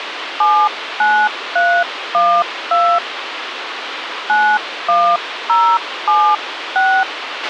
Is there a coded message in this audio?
Yes: DTMF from 0.4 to 7.0 s, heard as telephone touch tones, dialled by hand, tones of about 280 ms, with radio hiss and a squelch burst at the end. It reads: 79312 91076